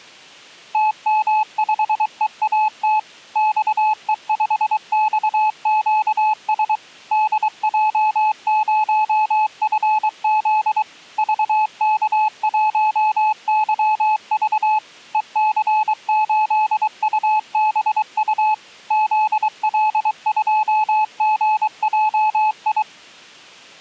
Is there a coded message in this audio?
Yes: Morse code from 0.7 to 22.9 s, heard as a keyed tone, machine-sent, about 23 wpm, 860 Hz. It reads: TM5EAT XE5XQS DJ0FZ VK1YV EC8UBU ZL2GJI